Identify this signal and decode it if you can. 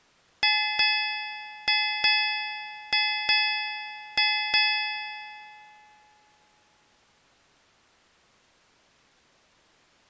Ship's bell, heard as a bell. 8. Eight half-hours of the watch have passed.